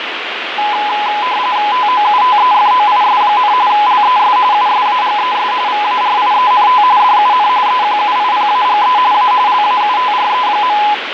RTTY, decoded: TOUTEFOIS, LES USAGES VARIENT DUN EQUIPAGE A LAUTRE.

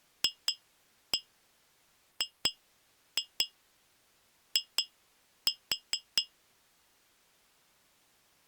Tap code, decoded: FGI

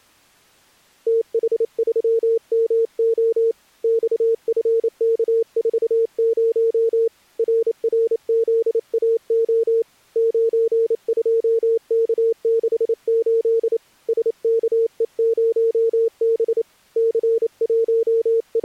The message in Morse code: TH3MO XFK40 RRZAO 92K68 SKE0B …

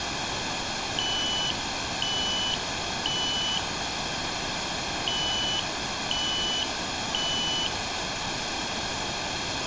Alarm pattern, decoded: temporal three

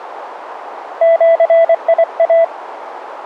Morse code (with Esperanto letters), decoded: ĜIA

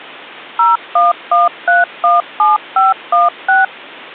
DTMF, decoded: 011317516

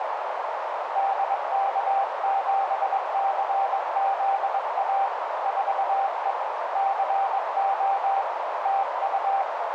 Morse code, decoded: DK7CZA 4E CO TU

